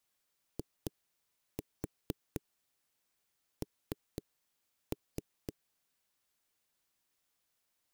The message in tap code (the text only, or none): IN